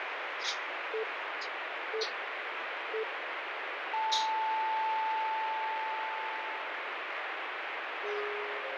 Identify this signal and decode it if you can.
Radio time signal (three low pips and a long one an octave up, as on NHK), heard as pips, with radio static.